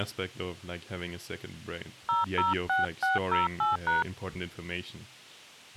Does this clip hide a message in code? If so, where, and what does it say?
Yes: DTMF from 2.1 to 4.0 s, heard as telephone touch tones, dialled by hand, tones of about 160 ms, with speech in English. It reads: 006608#